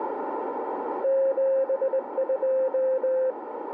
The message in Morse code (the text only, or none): 72